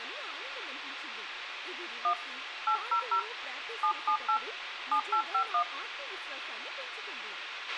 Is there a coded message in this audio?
Yes: DTMF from 2.0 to 5.6 s, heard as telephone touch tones, dialled by hand, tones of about 90 ms, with radio hiss, a squelch burst at the end, room echo and speech in Telugu. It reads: 1 800 778 7851